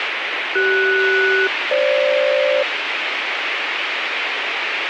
Aircraft SELCAL, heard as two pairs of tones, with radio hiss. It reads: CS-FG